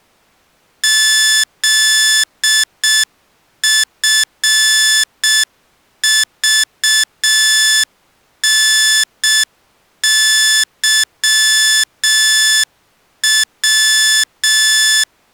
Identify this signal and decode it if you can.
Morse code, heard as electronic beeps, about 6 wpm, 1750 Hz. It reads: ZFVNYW